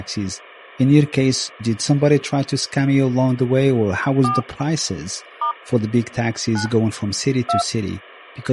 DTMF, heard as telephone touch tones, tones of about 150 ms, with speech in English. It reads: 4 * 9 2